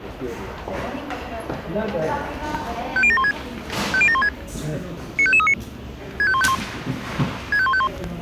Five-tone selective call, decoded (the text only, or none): 50716 50716 95539 65151 65151